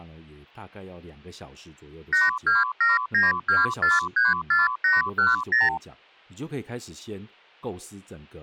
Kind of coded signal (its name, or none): multi-frequency trunk signalling